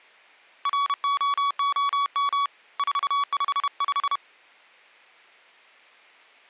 Morse code, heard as a keyed tone, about 31 wpm, 1130 Hz. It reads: ROOM 455